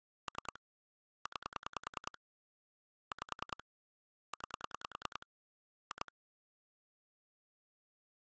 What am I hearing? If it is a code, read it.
Pulse dialling, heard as clicks on a phone line, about 10 pulses a second. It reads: 3 9 5 9 2